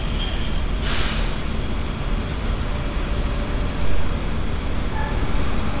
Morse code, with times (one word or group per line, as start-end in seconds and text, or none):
none